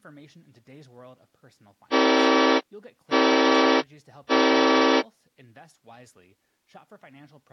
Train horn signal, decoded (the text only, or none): 3 short